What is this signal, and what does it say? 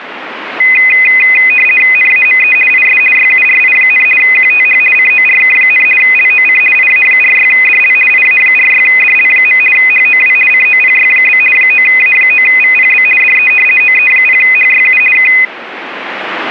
RTTY (50 baud, 450 Hz shift), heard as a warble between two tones, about 2250 Hz centre. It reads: NAME IS YURI, QTH CORK, LOC IA46DL IA46DL. HOW COPY? 9A9VPB DE OE0HYU K